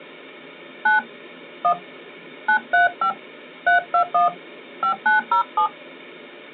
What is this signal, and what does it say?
DTMF, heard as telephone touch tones, dialled by hand, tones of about 110 ms. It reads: 9 1 935 321 5907